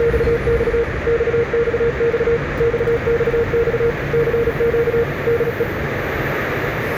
Morse code, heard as a keyed tone, machine-sent, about 36 wpm, 470 Hz, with radio static, a narrow filter and the noise inside a subway train. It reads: … XXX XXX CQ DE